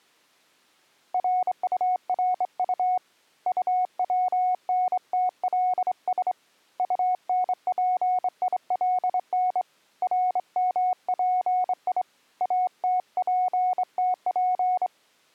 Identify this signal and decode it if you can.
Morse code, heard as a keyed tone, hand-sent with a straight key, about 25 wpm, 730 Hz. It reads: RURU UWNTLS UNPILN RMPI ATPTP